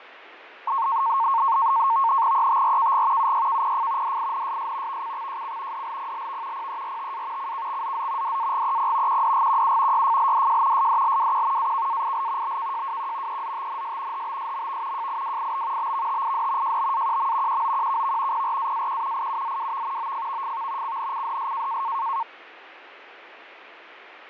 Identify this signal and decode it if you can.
NAVTEX (SITOR-B), 100 baud, 170 Hz shift, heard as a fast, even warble, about 1000 Hz centre, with radio static and fading. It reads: ETRKG UYKPF DINSS VCXJC DLPLV PERTA CKXZZ DAGEP QDGQU YFLDJ SDLWQ AKAIL BKJWQ EZTNS HBSMV JIWIB BVTID JBAQM QOQKV PRAAQ IUZWV OFVFV CNCDS